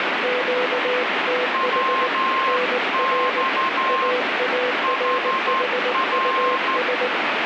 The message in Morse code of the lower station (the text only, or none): QTH NR AARHUS